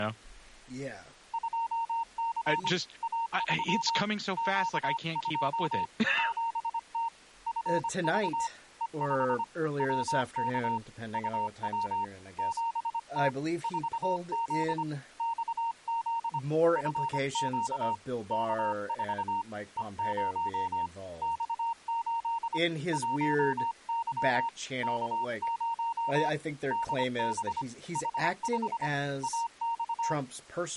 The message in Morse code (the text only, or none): 2C A3 Q2 7T FV E5 WK UW 7T 4Z XZ FQ K4 E0 X8 1Y K0 DB H5 AX